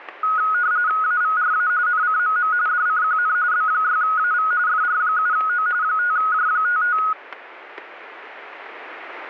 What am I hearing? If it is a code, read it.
RTTY (45.45 baud, 170 Hz shift), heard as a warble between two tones, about 1360 Hz centre, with static crashes. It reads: AVRA NCMM DCQN B6AV FR7O 5J55